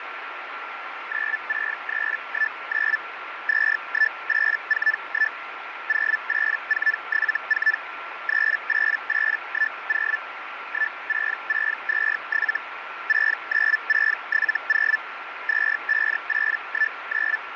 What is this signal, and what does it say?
Hellschreiber (Feld-Hell, 122.5 baud), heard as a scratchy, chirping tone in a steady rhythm, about 1750 Hz, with radio static and a steady whistle near 1360 Hz. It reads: 96319 21841 08474 38810 16627 69670 25819